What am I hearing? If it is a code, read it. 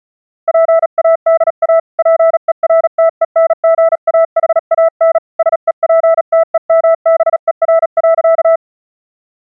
Morse code, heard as a keyed tone, hand-sent with a paddle, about 37 wpm, 660 Hz. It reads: PADA PERTENGAHAN SEPTEMBER.